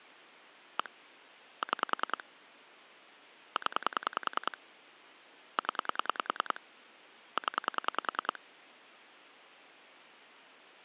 Pulse dialling, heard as clicks on a phone line, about 10 pulses a second. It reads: 1 6 0 0 0